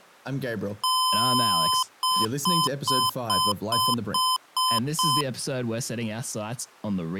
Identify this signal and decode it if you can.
Beep code, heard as beeps from a small speaker, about 1020 Hz, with speech in English. 1 long, 8 short. In AMI BIOS tables: display or retrace test failure.